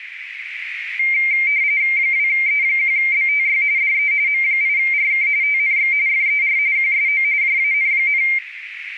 RTTY (45.45 baud, 170 Hz shift), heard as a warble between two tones, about 2200 Hz centre, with radio static and a narrow filter. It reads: 2E1BTY DE M8RK TNX FER QSO JAN,